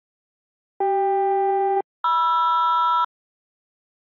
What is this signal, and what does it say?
Aircraft SELCAL, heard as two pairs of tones. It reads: CK-MR